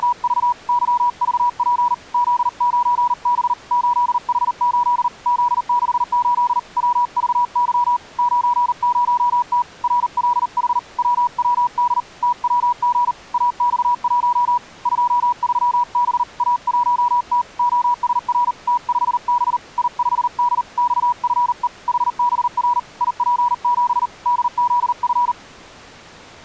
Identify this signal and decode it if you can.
Morse code, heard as a keyed tone, hand-sent with a paddle, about 39 wpm, 970 Hz. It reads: … YVP Z9B 8H8 Z68 WVY 90T RLH WWD TWG AX1 23B A1T OSR T5B I5D XFE HBR IP7 DZF